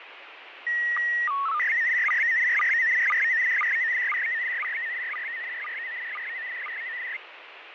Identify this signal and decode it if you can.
SSTV (slow-scan television), PD 120, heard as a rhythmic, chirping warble, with radio static and fading.